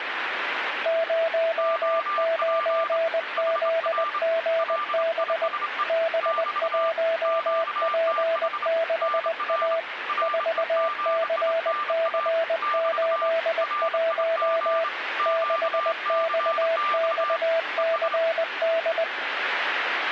Morse code, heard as two keyed tones, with radio static. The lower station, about 20 wpm, 660 Hz: 09ZGB B1P6A 4CC81 6XXCD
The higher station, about 27 wpm, 1190 Hz: OP HR LISE <BT> QTH NR REGINA <BT> RIG QCX ES